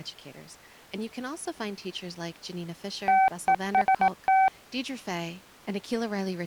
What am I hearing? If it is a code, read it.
Morse code, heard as a keyed tone, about 18 wpm, 760 Hz, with speech in English. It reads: TEST